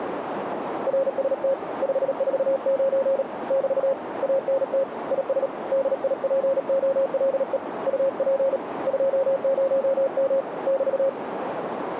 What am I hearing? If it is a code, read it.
Morse code, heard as a keyed tone, hand-sent with a paddle, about 37 wpm, 540 Hz, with radio static and a narrow filter. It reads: RST 549 <BT> ANT IS DIPOLE UP 20M <BT>